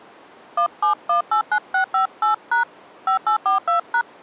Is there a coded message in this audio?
Yes: DTMF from 0.6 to 4.0 s, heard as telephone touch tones, dialled by hand, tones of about 100 ms. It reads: 17189658# 5842#